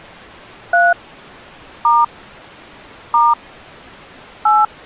DTMF, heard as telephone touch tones, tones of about 200 ms. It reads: 3 * * 8